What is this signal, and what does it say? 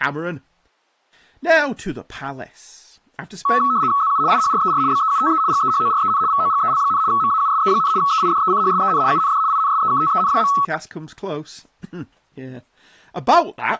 RTTY (75 baud, 170 Hz shift), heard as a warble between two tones, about 1210 Hz centre, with speech in English. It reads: ZU IHRER BEUTE GEHOREN VOGEL, MAUSE, EIDECHSEN UND INSEKTEN.